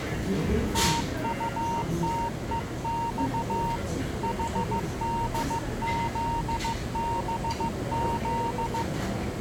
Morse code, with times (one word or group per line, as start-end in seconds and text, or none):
0.7-3.8 TUTEX
4.2-8.8 HDZBZ